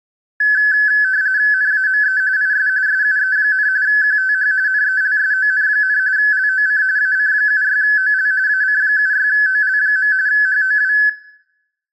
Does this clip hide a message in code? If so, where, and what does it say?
Yes: RTTY (45.45 baud, 170 Hz shift) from 0.4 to 11.1 s, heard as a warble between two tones, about 1600 Hz centre, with room echo. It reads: NAME IS SUE, QTH NELSON, LOC AC76OL AC76OL. HOW